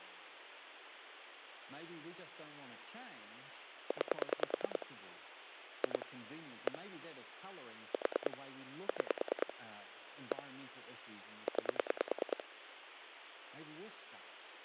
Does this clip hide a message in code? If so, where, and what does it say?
Yes: pulse dialling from 3.9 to 12.4 s, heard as clicks on a phone line, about 9 pulses a second, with speech in English. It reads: 9 2 1 4 6 1 9